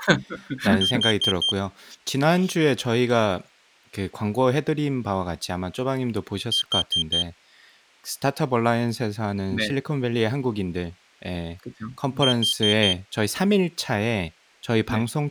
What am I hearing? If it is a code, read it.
Alarm pattern, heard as an alarm's beeps, played three times, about 3150 Hz, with speech in Korean. Temporal four. Carbon monoxide.